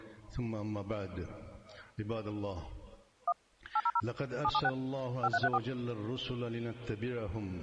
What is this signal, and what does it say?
DTMF, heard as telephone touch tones, dialled by machine, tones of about 50 ms. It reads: 1 800 776 5334